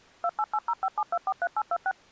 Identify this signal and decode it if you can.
DTMF, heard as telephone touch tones, dialled by machine, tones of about 50 ms. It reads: 288057243826